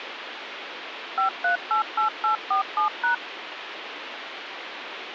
DTMF, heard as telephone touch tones, dialled by machine, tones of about 120 ms, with phone line noise. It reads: 5388847#